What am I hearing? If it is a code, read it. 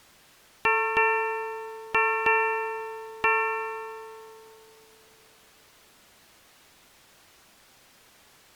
Ship's bell, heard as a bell. 5. Five half-hours of the watch have passed.